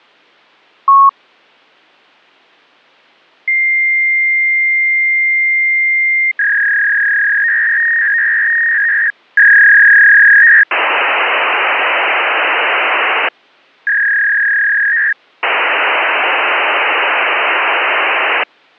Fax machine handshake, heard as a long tone, a warble and hiss.